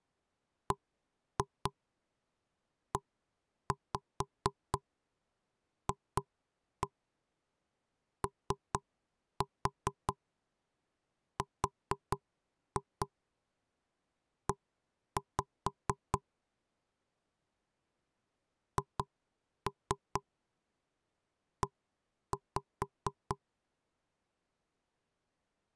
Tap code, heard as knocks on wood, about 4 knocks a second. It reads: BEFORE HE